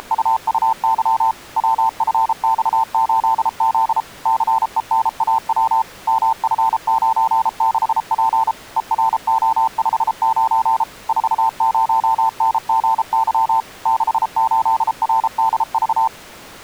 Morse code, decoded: … WFX8Z CENAW MF96P ERO59 40NGY 68RDV

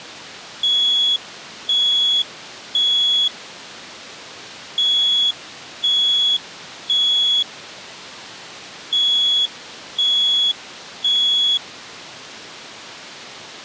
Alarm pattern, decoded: temporal three

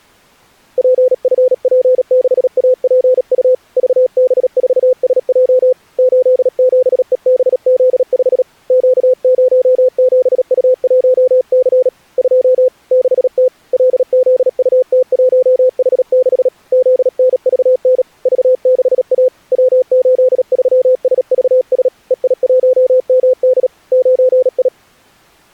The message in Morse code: PFP6APU VB4SJ 87EBZ5 Q07U1C 2 6T LZUT1H6 ZNVN V6A W83SVS EI1MD 9I

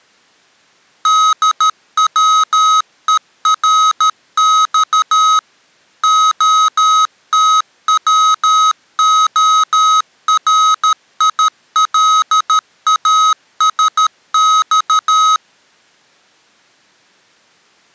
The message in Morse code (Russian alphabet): ДВЕРЬ ОТВОРИЛАСЬ

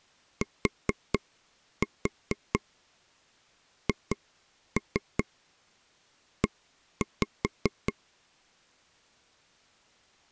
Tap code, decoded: THE

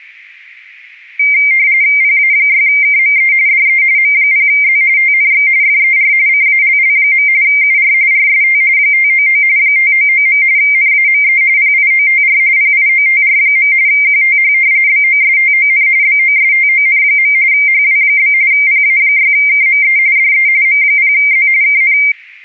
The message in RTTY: PA6KME DE M0Z TNX FER CALL. UR RST 599 599. NAME PIOTR PIOTR. QTH BOSTON BOSTON. HW? PA6KME DE M0Z KN

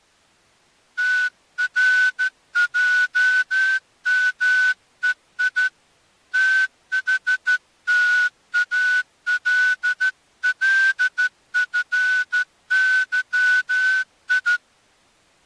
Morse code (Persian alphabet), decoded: ترجمهی تحتاللفظی

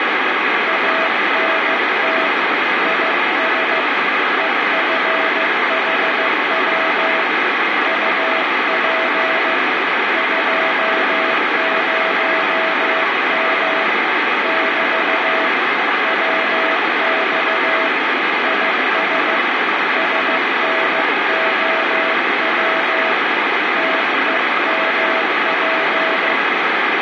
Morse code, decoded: ANT IS EFHW UP 20M <BT> WX IS SNOW TEMP

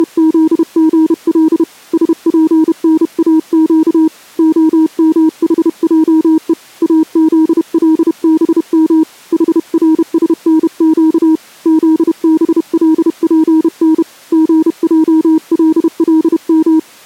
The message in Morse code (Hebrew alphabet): … שפנאק המחעו אזלבם חרשנק זבלפן געללם

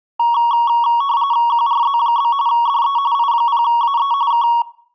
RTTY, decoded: QRZ? DE I0AE K

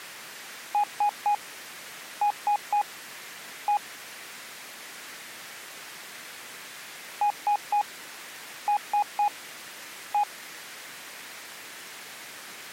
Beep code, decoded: 3-3-1

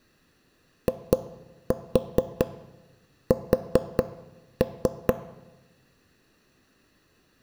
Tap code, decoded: IS

